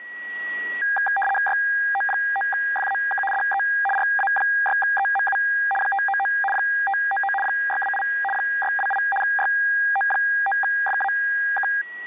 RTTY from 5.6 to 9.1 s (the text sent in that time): 599 599 628 628